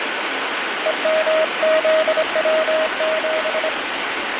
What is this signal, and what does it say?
Morse code, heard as a keyed tone, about 25 wpm, 630 Hz, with heavy radio static. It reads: EMZW7